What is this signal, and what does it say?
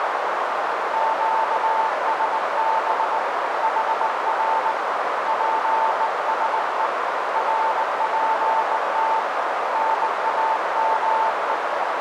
Morse code, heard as a keyed tone, hand-sent with a bug key, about 19 wpm, 890 Hz, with heavy radio static and a narrow filter. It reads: QSB HR PSE RPT NAME